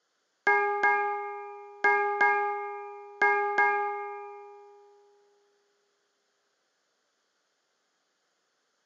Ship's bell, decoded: 6

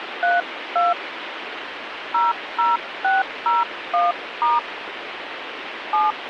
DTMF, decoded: 32 00601* 7

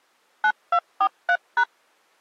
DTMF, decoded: 9243#

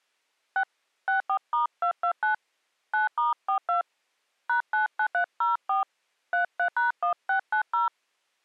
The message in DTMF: 6 64*229 9*42 #99304 33#1690

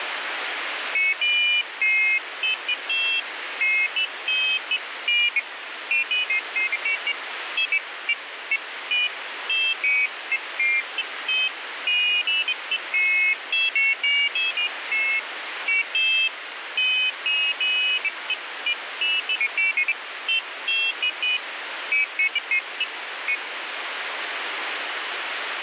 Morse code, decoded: none

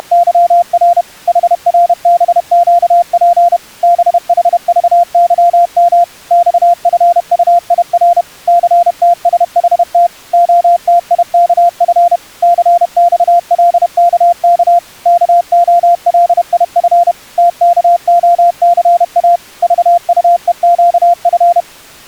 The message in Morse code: … HRBQP BHVYM XFUIR CTSHT OTIKF CXLKK KOLIF TKOCA VUEQF

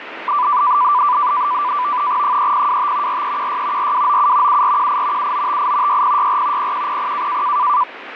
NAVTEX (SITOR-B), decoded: 3025 4316 4297 7418 7958 6064 0100

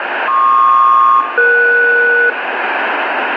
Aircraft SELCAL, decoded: PQ-ES

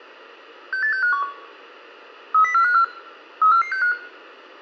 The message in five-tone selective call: 68651 30454 34465

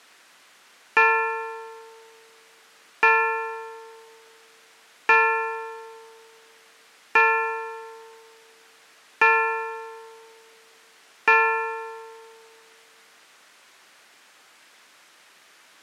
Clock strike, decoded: 6

